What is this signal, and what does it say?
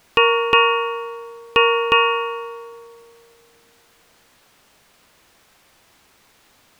Ship's bell, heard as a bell. 4. Four half-hours of the watch have passed.